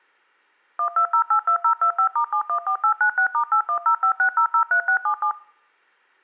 DTMF, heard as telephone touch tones, dialled by machine, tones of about 90 ms. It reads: 12082025*714896*81056003677